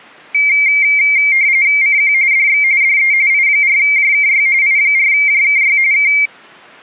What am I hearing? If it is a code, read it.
RTTY (45.45 baud, 170 Hz shift), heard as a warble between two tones, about 2200 Hz centre. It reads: CQ DX DE I4JKY I4JKY K